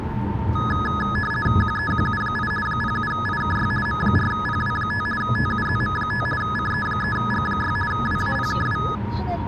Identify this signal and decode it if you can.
RTTY (50 baud, 450 Hz shift), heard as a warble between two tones, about 1480 Hz centre, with the noise inside a car. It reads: QEQU8 07IKY M4PW5 TUZM5 CE3G6 WAPKW